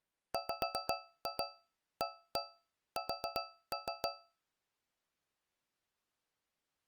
Tap code, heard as taps on a metal pipe, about 7 knocks a second. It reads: WAS